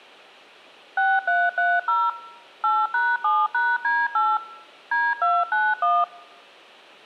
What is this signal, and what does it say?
DTMF, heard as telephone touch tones, dialled by machine, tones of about 220 ms. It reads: 6330 8#7#D8 D291